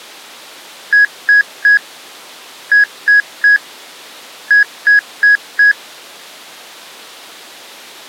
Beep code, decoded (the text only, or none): 3-3-4